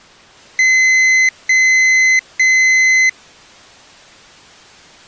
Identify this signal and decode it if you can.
Beep code, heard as a piezo beeper, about 2050 Hz. 3 long. In IBM BIOS tables: keyboard card error.